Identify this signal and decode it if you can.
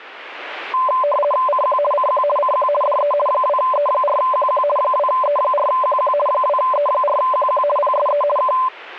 RTTY (50 baud, 450 Hz shift), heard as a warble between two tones, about 810 Hz centre. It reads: CQ CQ CQ DE 2E4QQ 2E4QQ 2E4QQ PSE K